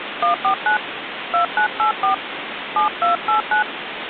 DTMF, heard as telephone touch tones, dialled by hand, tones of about 110 ms, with phone line noise. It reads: 149 2984 7289